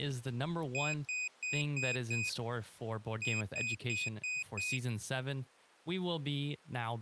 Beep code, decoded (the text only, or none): 5-5